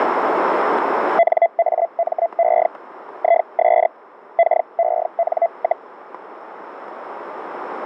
Hellschreiber (Feld-Hell, 122.5 baud), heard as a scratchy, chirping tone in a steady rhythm, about 680 Hz, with static crashes. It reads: NAME IS KEN,